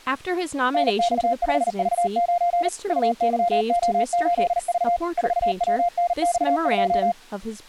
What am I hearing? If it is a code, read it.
Morse code, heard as a keyed tone, machine-sent, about 39 wpm, 700 Hz, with speech in English. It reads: NX5V9 UYO8V 4WNX2